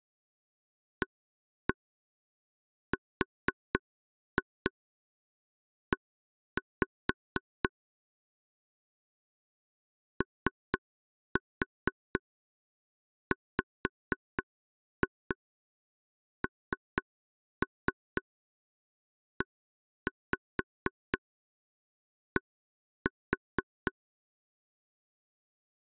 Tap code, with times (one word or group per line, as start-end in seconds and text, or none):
1.0-7.7 ARE
10.2-23.9 OWNED